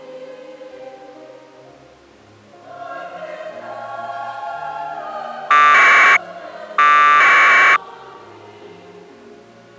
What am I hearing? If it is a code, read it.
Packet radio (AX.25, as in APRS), 1200 baud, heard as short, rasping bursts.